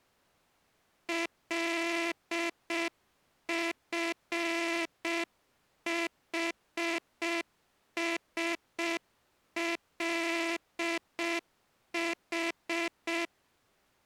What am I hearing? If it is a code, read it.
Morse code, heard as a buzzer, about 6 wpm. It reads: LFHSLH